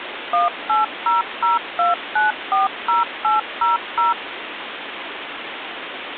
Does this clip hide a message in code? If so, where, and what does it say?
Yes: DTMF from 0.3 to 4.1 s, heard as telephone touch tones, dialled by machine, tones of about 150 ms, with phone line noise. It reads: 18002940800